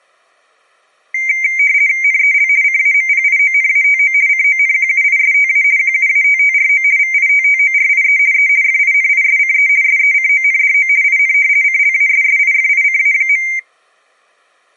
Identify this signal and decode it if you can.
RTTY (50 baud, 170 Hz shift), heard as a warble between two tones, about 2200 Hz centre. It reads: NEL CAMPIONATO CONQUISTA QUATTRO VITTORIE E FINISCE SECONDO IN CLASSIFICA.